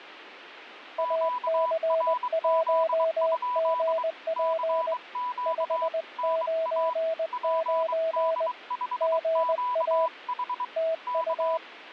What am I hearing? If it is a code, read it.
Morse code, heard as two keyed tones, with radio static. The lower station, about 20 wpm, 650 Hz: AC1GP 599 GA TU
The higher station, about 23 wpm, 990 Hz: QRZ? CQ NA PD5QH K